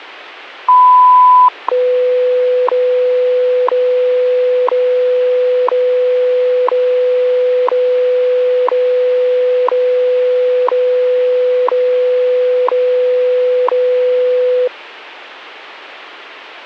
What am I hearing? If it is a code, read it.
Radio time signal (WWV, Colorado), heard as ticks, one a second.